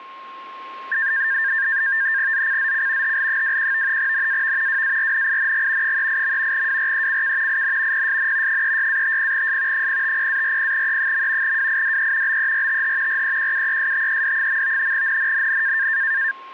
NAVTEX (SITOR-B), 100 baud, 170 Hz shift, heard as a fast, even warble, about 1700 Hz centre, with a steady whistle near 1070 Hz. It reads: ZCZC HL21 NAV WARNING 38. WRECK IN PSN 36-50S 050-40E. WIDE BERTH REQUESTED. NNNN